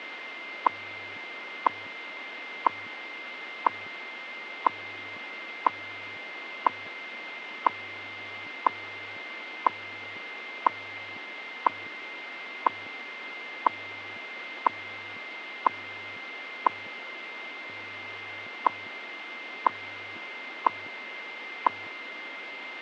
Radio time signal (WWV, Colorado), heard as ticks, one a second, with radio static and a steady whistle near 2090 Hz.